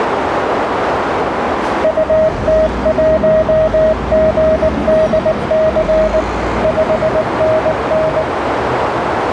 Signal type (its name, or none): Morse code